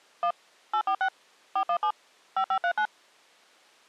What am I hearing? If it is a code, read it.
DTMF, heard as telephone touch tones, dialled by machine, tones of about 80 ms. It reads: 1 846 417 5539